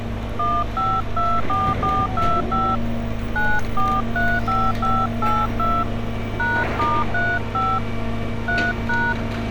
DTMF, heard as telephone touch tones, dialled by hand, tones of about 240 ms, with street noise. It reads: 1524425 9435582 #*35 3#